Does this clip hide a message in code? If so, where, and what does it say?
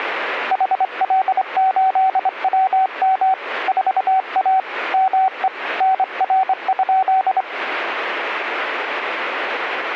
Yes: Morse code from 0.5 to 7.5 s, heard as a keyed tone, hand-sent with a straight key, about 25 wpm, 760 Hz. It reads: HL8WM 4A ME NR?